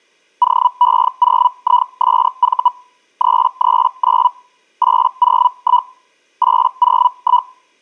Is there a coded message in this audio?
Yes: Hellschreiber (Feld-Hell, 122.5 baud) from 0.4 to 7.5 s, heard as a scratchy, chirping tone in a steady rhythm, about 980 Hz. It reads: OE0ISV 339 801 801